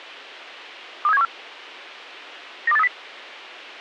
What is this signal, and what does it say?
Five-tone selective call (EEA), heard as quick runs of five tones, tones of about 40 ms. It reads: 23714 92830